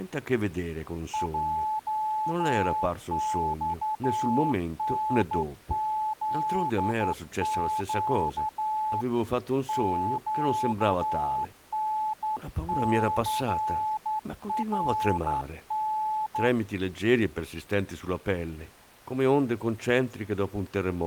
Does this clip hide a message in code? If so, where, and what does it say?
Yes: Morse code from 1.1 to 16.5 s, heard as a keyed tone, hand-sent with a straight key, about 11 wpm, 860 Hz, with speech in Italian. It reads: JXNZQ QNCRN